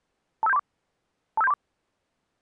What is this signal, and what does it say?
Five-tone selective call (EIA), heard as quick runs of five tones, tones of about 30 ms. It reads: 25734 25734